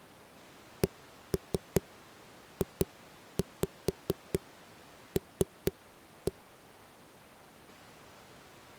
Tap code, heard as knocks on a wall, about 4 knocks a second. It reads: CJL